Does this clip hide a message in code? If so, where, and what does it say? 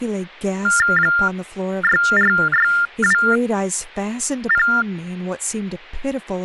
Yes: TTY/TDD text telephone tones (45.45 baud Baudot) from 0.6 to 4.8 s, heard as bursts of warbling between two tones, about 400 Hz shift, 1600 Hz centre, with speech in English. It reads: 64620